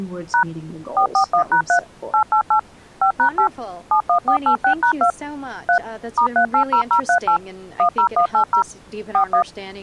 DTMF, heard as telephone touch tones, dialled by machine, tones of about 90 ms, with speech in English. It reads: # 441#3 888 5#8 71486#2 3 *380038 10180 41